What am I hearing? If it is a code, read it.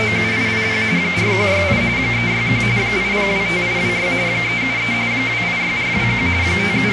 RTTY (45.45 baud, 170 Hz shift), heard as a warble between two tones, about 2200 Hz centre, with radio static. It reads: … 4168 361 8025826 373 286421 …